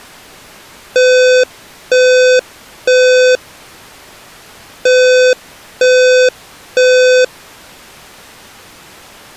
Alarm pattern, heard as an alarm's beeps, played twice, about 510 Hz. Temporal three. Smoke or fire, evacuate.